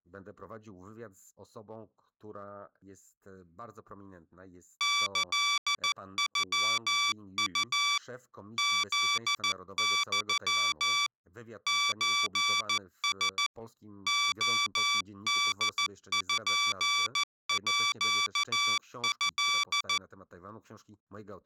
Morse code (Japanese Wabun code), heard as electronic beeps, machine-sent, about 14 wpm, 1160 Hz. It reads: キノウ フユ ソラ レポート